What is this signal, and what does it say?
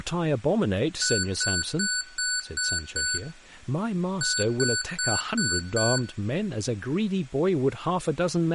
Beep code, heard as beeps from a small speaker, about 1490 Hz, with room echo and speech in English. 6-5.